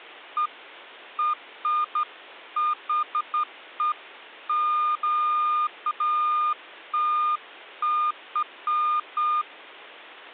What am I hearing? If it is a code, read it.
Beeps of irregular length. There is no code.